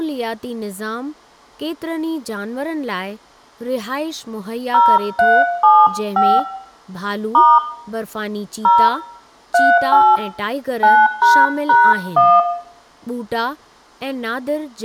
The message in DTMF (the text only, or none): 0375 * 0 38 9##1